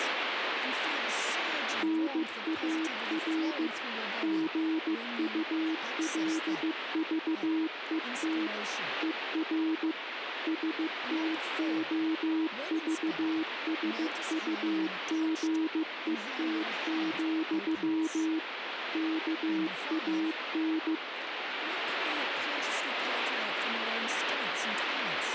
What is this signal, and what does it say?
Morse code, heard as a keyed tone, machine-sent, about 15 wpm, 320 Hz, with radio static and speech in English. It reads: NAR GULVET ER STOVSUGET, KAN